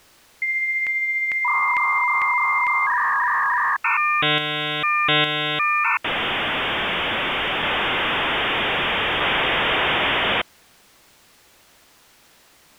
Dial-up modem handshake (V.34 or later), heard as a whistle, warbles, then hiss.